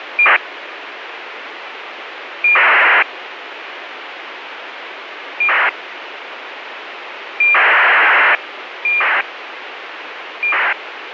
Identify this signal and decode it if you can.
ACARS aircraft data, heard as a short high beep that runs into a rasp, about 2400 baud, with radio hiss.